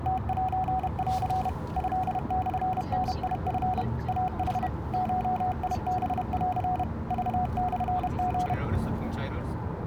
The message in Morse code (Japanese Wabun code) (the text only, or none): ムセン トモダチ イヌ ゴハン クモリ